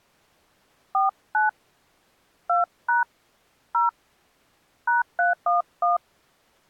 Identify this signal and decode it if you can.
DTMF, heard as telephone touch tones, dialled by hand, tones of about 150 ms. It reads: 49 2# 0 #311